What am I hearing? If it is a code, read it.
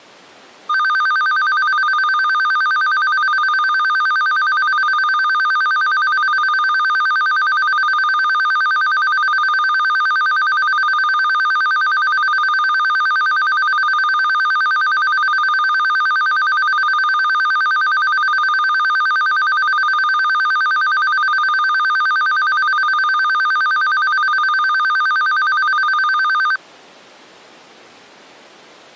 A tone that alternates evenly between two pitches. There is no code.